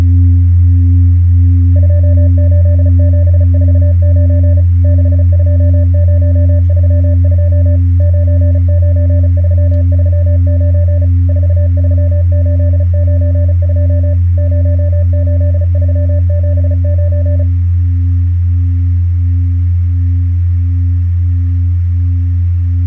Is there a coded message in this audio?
Yes: Morse code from 1.7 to 17.5 s, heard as a keyed tone, machine-sent, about 35 wpm, 590 Hz. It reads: 28749 62032 99339 43892 08379